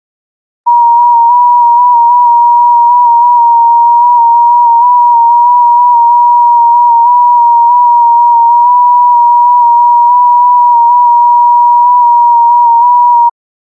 FT8 (one signal), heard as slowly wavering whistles, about 6.25 baud.